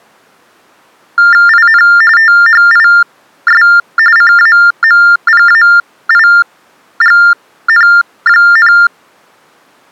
TTY/TDD text telephone tones (45.45 baud Baudot), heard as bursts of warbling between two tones, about 400 Hz shift, 1600 Hz centre. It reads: IN THIS CAMPAIGN,